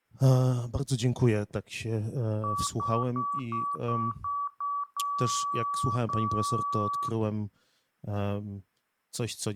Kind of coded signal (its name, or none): beep code